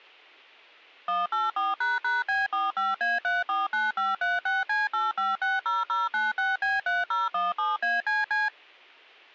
DTMF, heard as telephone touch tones, dialled by machine, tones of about 180 ms. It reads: 184##B45A349536C8560096B3017ACC